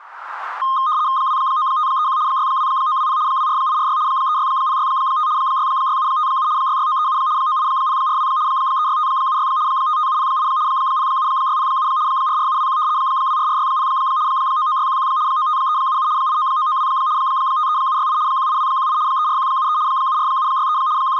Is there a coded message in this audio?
Yes: RTTY (75 baud, 170 Hz shift) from 0.6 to 21.2 s, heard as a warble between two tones, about 1150 Hz centre, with static crashes. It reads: 29531 62920 24846 36065 66757 66937 98042 36576 55708 07607 44721 24460 99611 95377 89992 53768 18218 34173 74763 …